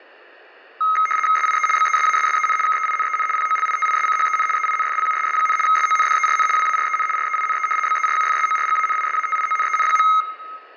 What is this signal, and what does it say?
RTTY (75 baud, 850 Hz shift), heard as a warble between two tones, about 1700 Hz centre, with room echo. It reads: SIE BESASSEN KEINEN POLITISCHEN EINFLUSS, SONDERN WAREN REINE BERUFSORGANISATIONEN.